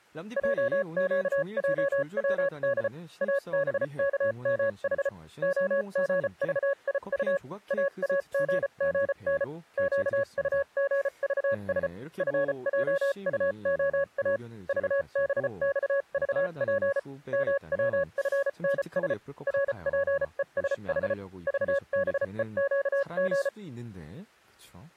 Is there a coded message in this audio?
Yes: Morse code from 0.3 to 23.5 s, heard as a keyed tone, machine-sent, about 34 wpm, spaced as for 30 wpm, 560 Hz, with speech in Korean. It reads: JQJWD ABKMH OGVIU AAGGN QUGVS FJUOA VBXVP MWFNS RPESH VBEQG